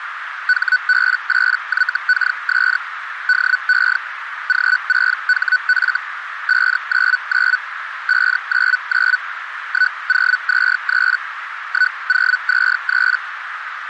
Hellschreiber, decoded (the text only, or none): HB8YKS DE G6HF 599 599 1023 1023